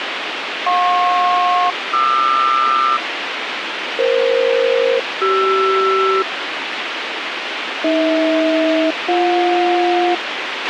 Aircraft SELCAL, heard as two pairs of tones, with radio hiss and a squelch burst at the end. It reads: JP-QR EF-CR AH-BJ